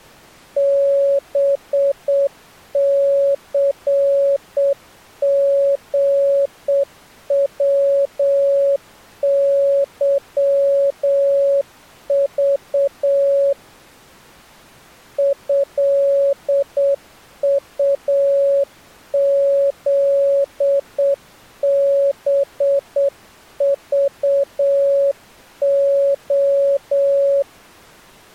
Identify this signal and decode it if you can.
Morse code (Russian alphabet), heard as a keyed tone, hand-sent with a straight key, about 7 wpm, 560 Hz. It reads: БЦГВЫЖ ЭУЗБЖО